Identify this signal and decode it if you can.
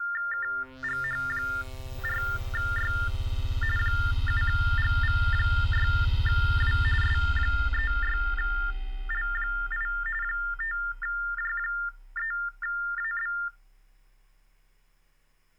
TTY/TDD text telephone tones (45.45 baud Baudot), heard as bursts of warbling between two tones, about 400 Hz shift, 1600 Hz centre. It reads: KGH4Y 7GV6W S36L8 5J3AB